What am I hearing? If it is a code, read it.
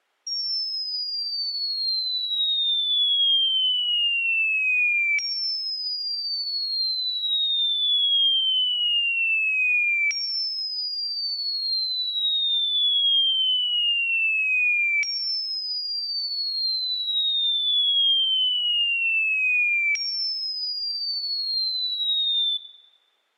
A tone that sweeps in pitch again and again. There is no code.